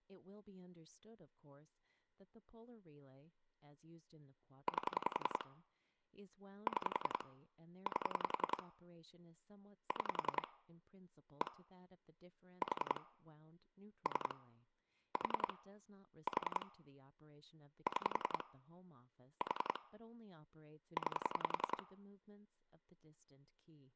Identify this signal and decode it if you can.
Pulse dialling, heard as clicks on a phone line, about 10 pulses a second, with speech in English. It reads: 8 6 8 6 1 4 3 4 4 6 4 9